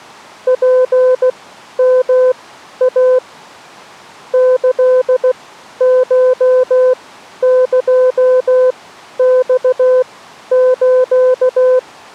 Morse code (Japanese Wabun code), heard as a keyed tone, machine-sent, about 16 wpm, spaced as for 11 wpm, 510 Hz. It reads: ツヨイ キコエマス